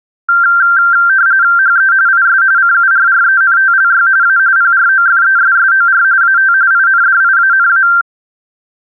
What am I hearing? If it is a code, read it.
RTTY (45.45 baud, 170 Hz shift), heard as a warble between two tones, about 1470 Hz centre. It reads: HE IS CURRENTLY A PROFESSOR AT INDIANA